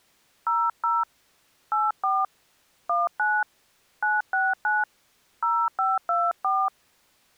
DTMF, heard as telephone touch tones, dialled by hand, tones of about 210 ms. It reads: 00 84 19 969 0524